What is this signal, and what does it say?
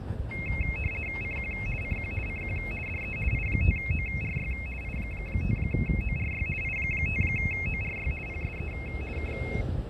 RTTY (50 baud, 450 Hz shift), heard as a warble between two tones, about 2350 Hz centre, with fading and the noise of a residential street. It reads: CQ CQ CQ DE I5ORY I5ORY I5ORY PSE K